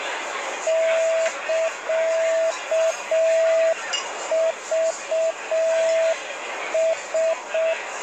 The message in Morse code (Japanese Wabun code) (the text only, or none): サクラ